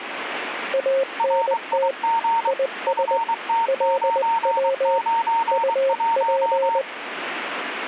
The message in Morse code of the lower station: ANT IS LW UP

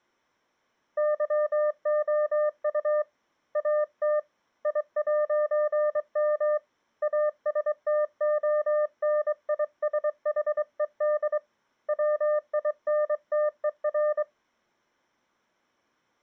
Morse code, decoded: YOU AT I'M ASTONISHED WINTER

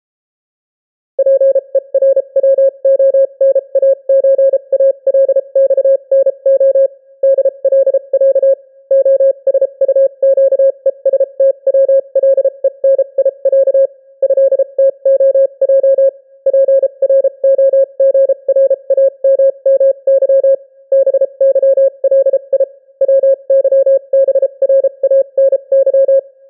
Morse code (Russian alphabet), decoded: ПЕРВОНАЧАЛЬНО ДЛЯ ОСУЩЕСТВЛЕНИЯ ЭТОЙ ПРОГРАММЫ БЫЛИ ВЫБРАНЫ

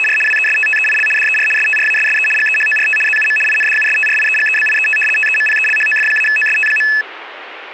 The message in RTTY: … WESTTEIL DER STRASSE GEHORT ZUM INDUSTRIEGEBIET TEMPELHOF-OST.

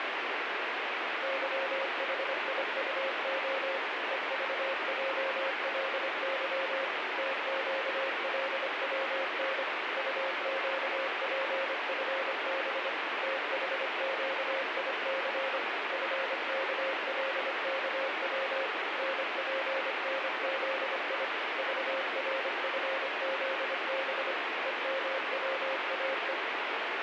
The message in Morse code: YHIUO EVJLY TQLWN UQPFB THQIC FKLKW NPNZI VRFZB EMWAE

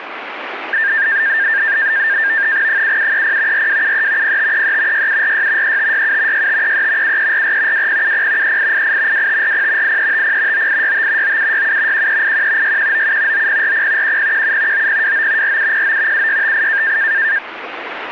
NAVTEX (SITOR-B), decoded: 7730 4273 0533 6746 3567 6533 7344 2070 3888 2540 8350 9865 9767 1381 6197 9040 1017 9029 4709 7658

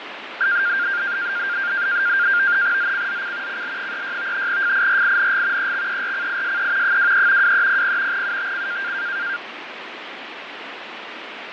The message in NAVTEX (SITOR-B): ZCZC CL36 FIRING EXERCISE 23 2300 UTC

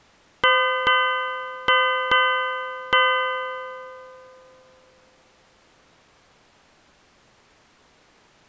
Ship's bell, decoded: 5

